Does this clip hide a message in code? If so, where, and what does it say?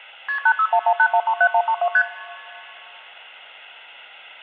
Yes: multi-frequency trunk signalling (R1, as on North American trunks) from 0.3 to 2.0 s, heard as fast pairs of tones, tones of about 70 ms. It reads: KP 86118137132 ST